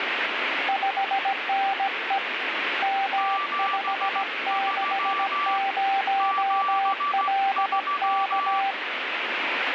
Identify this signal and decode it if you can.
Morse code, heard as two keyed tones, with radio static. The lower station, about 17 wpm, 780 Hz: 5NE M560LK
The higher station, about 15 wpm, 1160 Hz: 73 73